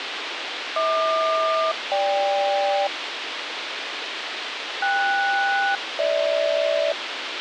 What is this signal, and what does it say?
Aircraft SELCAL, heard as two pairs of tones, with radio hiss. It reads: HQ-GK KS-GH